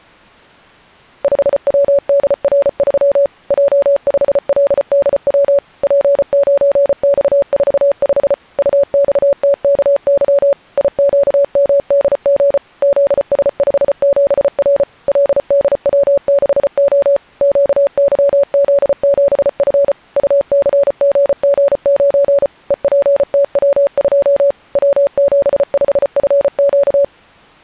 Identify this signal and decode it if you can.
Morse code, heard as a keyed tone, machine-sent, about 34 wpm, 560 Hz. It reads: 5WDR3 J5LDW P9X45 UXTKY IQMDG ZS57R LDW6O QYZ7F UCGG9 EPTW2 W75FQ